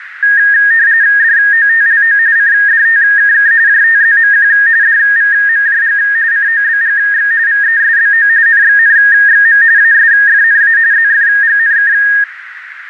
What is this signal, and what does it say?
RTTY (45.45 baud, 170 Hz shift), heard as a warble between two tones, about 1750 Hz centre, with radio static and a narrow filter. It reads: DOTLO CDTKK JTZMQ DVMJG COBGX VESBO NXNXM ASFNA ZFGNK